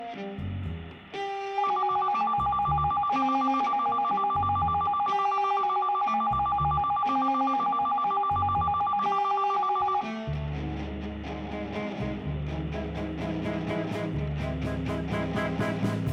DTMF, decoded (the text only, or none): none